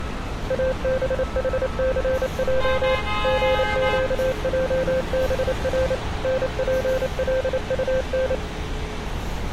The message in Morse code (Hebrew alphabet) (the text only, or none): אבחסע גקעבר נפלטן